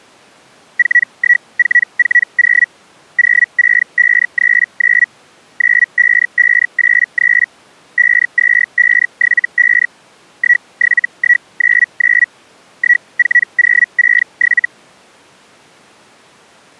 Hellschreiber (Feld-Hell, 122.5 baud), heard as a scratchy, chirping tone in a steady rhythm, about 1950 Hz. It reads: 41440 06539 95583 52575 17199 14067